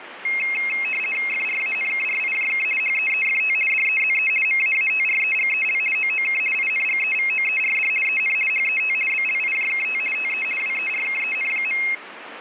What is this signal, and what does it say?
RTTY (50 baud, 450 Hz shift), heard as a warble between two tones, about 2350 Hz centre, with radio static. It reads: FRANKRIJK HEEFT DEZE MAATREGEL OOK INGEVOERD EN HET BLIJKT TE WERKEN.